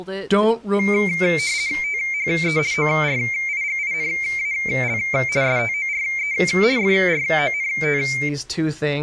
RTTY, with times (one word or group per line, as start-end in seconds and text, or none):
1.8-2.6 THE
2.7-5.0 ORIGINAL
5.4-6.3 STORE
6.8-8.0 FRONT